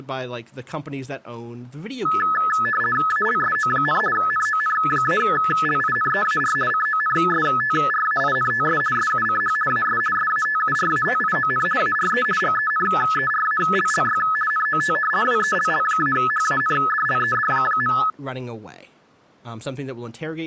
RTTY (50 baud, 450 Hz shift), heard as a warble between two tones, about 1500 Hz centre, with speech in English. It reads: ALSO, NON-LINEAR CONSTRAINTS SUCH AS SATURATION ARE GENERALLY NOT WELL-HANDLED.